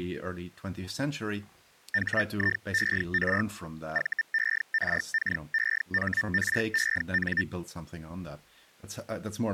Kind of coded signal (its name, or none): Hellschreiber